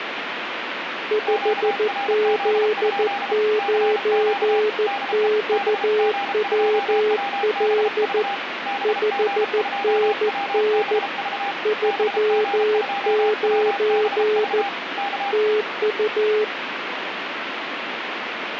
Morse code, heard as two keyed tones, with radio static. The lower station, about 14 wpm, 430 Hz: 5Z9XWL 5NN 39 TU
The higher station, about 33 wpm, 800 Hz: QRZ? CQ DE BG2WBV BG2WBV BG2WBV K